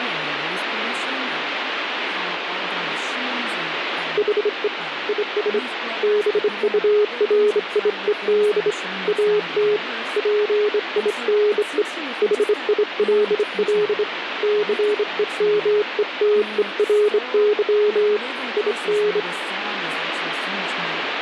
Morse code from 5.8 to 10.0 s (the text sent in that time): BURIED AT